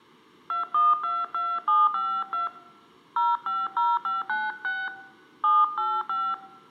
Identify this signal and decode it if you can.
DTMF, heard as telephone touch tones, dialled by hand, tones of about 210 ms. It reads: 2122752 050596 785